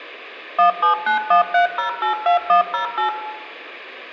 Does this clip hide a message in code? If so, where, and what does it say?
Yes: DTMF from 0.6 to 3.1 s, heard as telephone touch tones, dialled by machine, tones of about 120 ms, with room echo. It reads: 17913082108